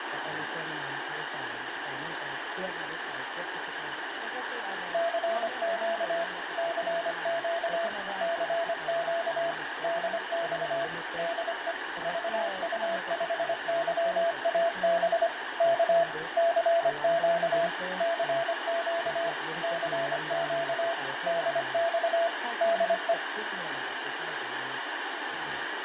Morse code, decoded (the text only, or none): CQ CQ CQ DX DE VU5YAB K CQ CQ CQ DX DE